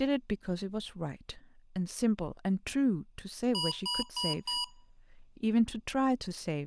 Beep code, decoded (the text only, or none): 4 short